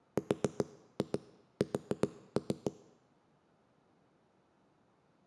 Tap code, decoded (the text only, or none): RS